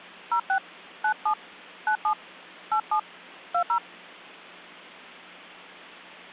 DTMF, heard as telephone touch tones, dialled by hand, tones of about 90 ms. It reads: 06 97 97 87 20